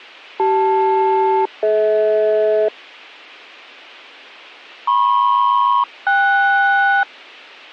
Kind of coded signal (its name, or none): aircraft SELCAL